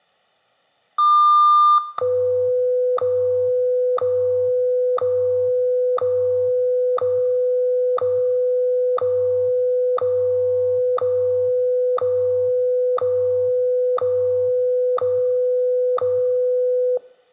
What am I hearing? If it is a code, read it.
Radio time signal (WWVH, Hawaii), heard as ticks, one a second.